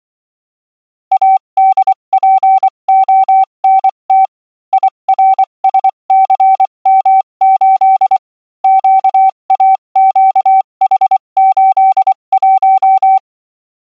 Morse code, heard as a keyed tone, machine-sent, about 24 wpm, spaced as for 21 wpm, 770 Hz. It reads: ADPONT IRSCM8 QAQH81